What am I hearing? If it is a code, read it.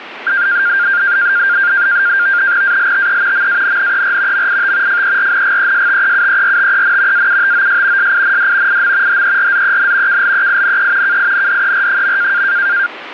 NAVTEX (SITOR-B), 100 baud, 170 Hz shift, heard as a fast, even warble, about 1500 Hz centre, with radio static. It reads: ALTE MANNER MIT FERNGESTEUERTEN AUTOS SIND IM HERZEN KLEINE KINDER.